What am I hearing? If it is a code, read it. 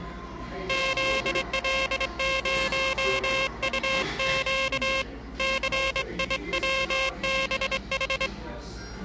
Morse code, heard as a buzzer, hand-sent with a straight key, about 24 wpm, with the noise of a cafe. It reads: ZL0UQ CIWBH